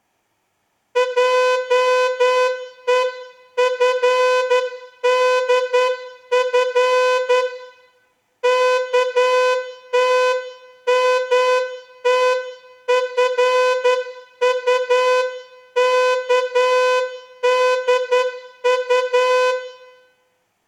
Morse code (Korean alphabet), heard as a horn, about 10 wpm, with room echo. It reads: 하는 어머니의